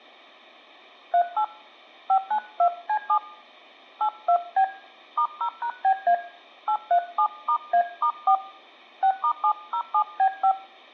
DTMF, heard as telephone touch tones, dialled by hand, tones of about 80 ms. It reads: 38 592C7 82B *0#BA 837*A*4 6*707B5